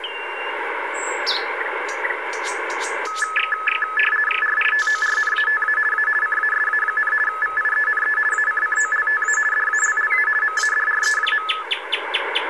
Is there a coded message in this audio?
Yes: RTTY (50 baud, 450 Hz shift) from 3.1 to 11.6 s, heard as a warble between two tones, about 1500 Hz centre, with radio static. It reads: RITORNATA A CASA, VIENE ACCOLTA DALLA MADRE.